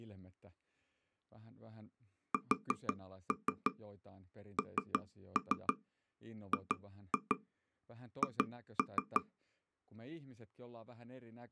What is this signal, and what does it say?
Tap code, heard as taps on a table, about 6 knocks a second, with speech in Finnish. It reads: SNGH